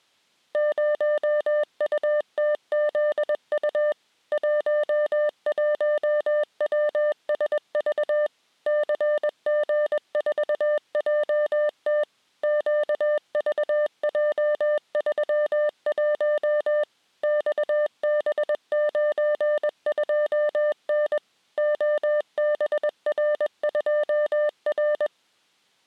Morse code, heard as a keyed tone, machine-sent, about 21 wpm, 600 Hz. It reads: 0UTZU 11WSV CG4JT QVJ31 XB92N OBR2R